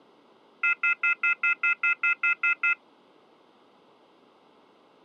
Telephone call progress tone (North American plan), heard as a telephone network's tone, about 1400, 2050, 2450, 2600 Hz, 0.1 s on and 0.1 s off. Off-hook warning tone.